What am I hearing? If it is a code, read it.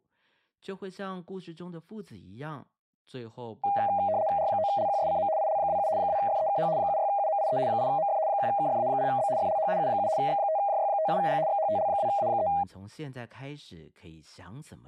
RTTY (75 baud, 170 Hz shift), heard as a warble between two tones, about 720 Hz centre, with speech in Chinese. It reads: R9LQSCM IL27 2FEKH 76UMIE 8MF 1KFA0B FLH U7 X5JY57G XHTL2A3